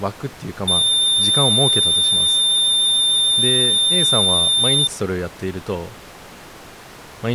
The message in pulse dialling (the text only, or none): none